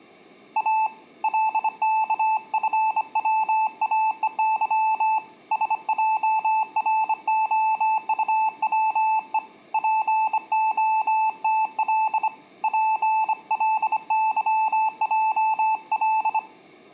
Morse code, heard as a keyed tone, hand-sent with a bug key, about 25 wpm, 880 Hz. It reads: A LKFWAEY SJROUWE POTL PLYJL